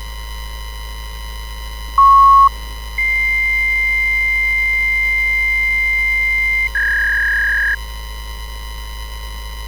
Fax machine handshake, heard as a beep, a long tone and a warble, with street noise.